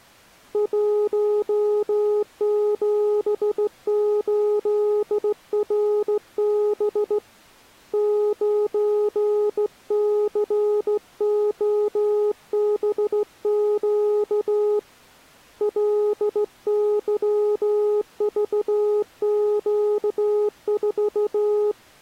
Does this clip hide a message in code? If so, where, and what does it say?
Yes: Morse code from 0.5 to 21.8 s, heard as a keyed tone, hand-sent with a straight key, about 15 wpm, 420 Hz. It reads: 178RB 9COBQ LYVQ4